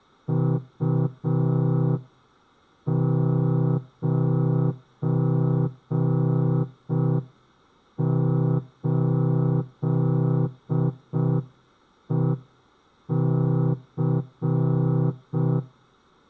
Morse code, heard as a horn, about 5 wpm. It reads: U98EC